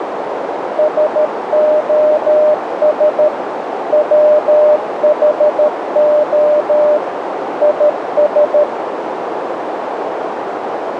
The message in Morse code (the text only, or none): SOS WHO IS